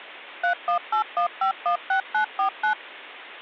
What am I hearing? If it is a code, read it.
DTMF, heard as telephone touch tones, dialled by machine, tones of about 100 ms. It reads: 3181516949